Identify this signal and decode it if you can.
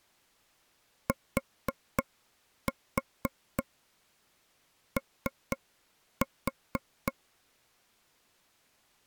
Tap code, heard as taps on a table, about 3 knocks a second. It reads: TO